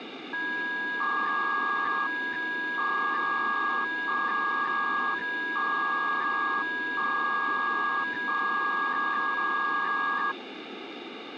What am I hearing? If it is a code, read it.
300-baud modem data (V.21 tones), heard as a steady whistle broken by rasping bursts, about 300 baud, 200 Hz shift, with phone line noise.